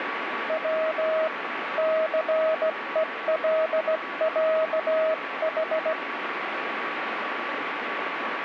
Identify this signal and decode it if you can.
Morse code (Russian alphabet), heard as a keyed tone, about 17 wpm, 640 Hz, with heavy radio static. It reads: В ЦЕЛЯХ